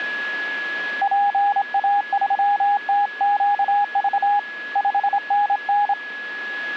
Morse code, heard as a keyed tone, hand-sent with a straight key, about 26 wpm, 820 Hz, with a steady whistle near 1680 Hz. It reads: PA3TQV 5NN